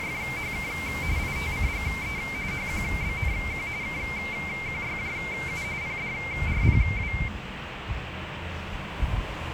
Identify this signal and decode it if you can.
RTTY (45.45 baud, 170 Hz shift), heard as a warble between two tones, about 2200 Hz centre, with radio static and the noise of a residential street. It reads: … ITCGE HQBNQ KQYJU PDRPW